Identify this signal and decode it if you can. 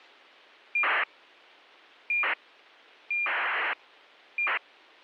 ACARS aircraft data, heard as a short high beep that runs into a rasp, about 2400 baud.